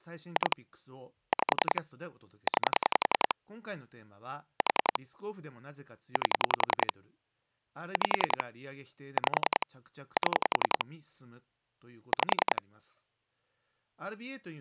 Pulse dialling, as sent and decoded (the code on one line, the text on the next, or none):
2 / 5 / 9 / 4 / 8 / 5 / 5 / 7 / 5
2 5 9 4 8 5 5 7 5